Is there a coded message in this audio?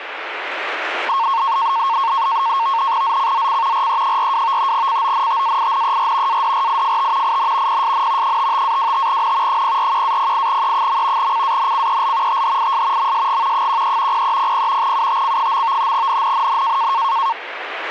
Yes: NAVTEX (SITOR-B), 100 baud, 170 Hz shift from 1.1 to 17.3 s, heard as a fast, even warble, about 1000 Hz centre, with radio static. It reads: ZCZC RE42 CONTAINER ADRIFT IN PSN 55-25N 041-08E. CANCEL THIS MSG 13 0300 UTC. NNNN